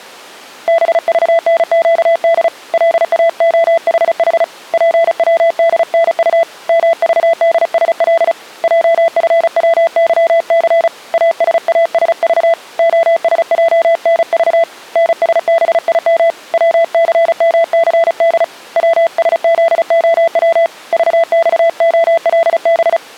Morse code, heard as a keyed tone, hand-sent with a paddle, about 35 wpm, 670 Hz. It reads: BVNQD LAOHH PWDNU MVDSL JFWYC ASASV OSJNV NSBIM WCMCD WSZOW VXOLB